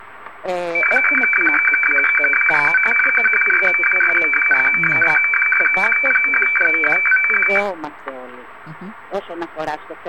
Weather fax (radiofax), 120 lines a minute, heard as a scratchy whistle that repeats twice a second, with static crashes.